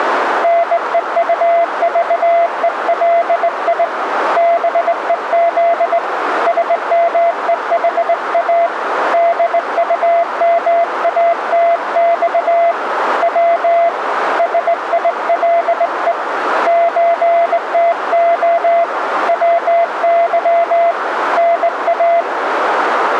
Morse code (Russian alphabet), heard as a keyed tone, hand-sent with a straight key, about 19 wpm, 680 Hz, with radio static and a narrow filter. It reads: НЕУЖЕЛИ БЕЗ СМЕХА ДУМАТЬ В СИЛЕ ЧТО ВЫ НА